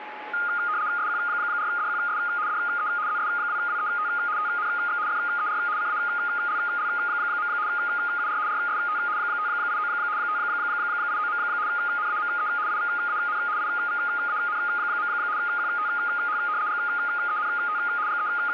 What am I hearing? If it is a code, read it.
RTTY (75 baud, 170 Hz shift), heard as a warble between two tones, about 1330 Hz centre, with radio static and a steady whistle near 850 Hz. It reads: SQ4DQS DE ZS2WET TNX FER CALL. UR RST 589 589. NAME IVAN IVAN. QTH GENT …